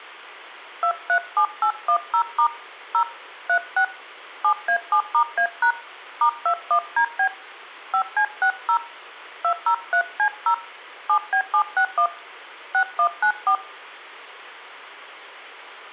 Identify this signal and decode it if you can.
DTMF, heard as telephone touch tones, dialled by hand, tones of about 80 ms. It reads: 237810* 0 36 7A7*A# *21DB 5C60 203C0 7B761 6194